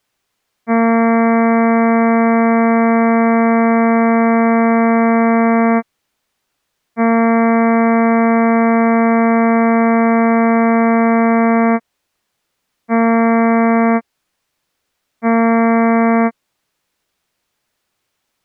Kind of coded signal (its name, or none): ship horn signal